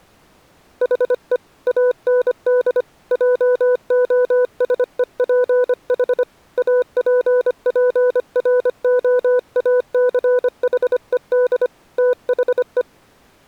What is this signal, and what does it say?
Morse code, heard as a keyed tone, hand-sent with a paddle, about 25 wpm, 500 Hz. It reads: HE AND JOSEPH APPROACHED THE